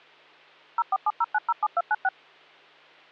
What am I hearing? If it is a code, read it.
DTMF, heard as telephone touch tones, dialled by machine, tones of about 40 ms, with hum. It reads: 0470907296